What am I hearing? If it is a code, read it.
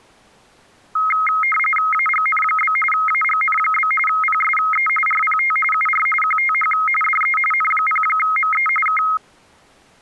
RTTY (45.45 baud, 850 Hz shift), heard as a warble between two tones, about 1700 Hz centre. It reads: AGN? AGN? PSE RPT UR QTH DE N0ME K